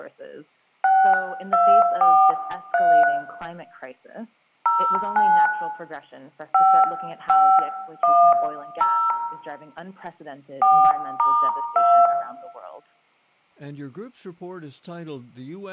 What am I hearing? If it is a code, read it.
DTMF, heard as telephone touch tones, dialled by hand, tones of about 300 ms, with room echo. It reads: 6243 09 5510 4*2